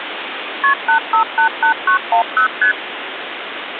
Multi-frequency trunk signalling (R1, as on North American trunks), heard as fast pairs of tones, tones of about 100 ms, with phone line noise. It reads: KP 8588910 ST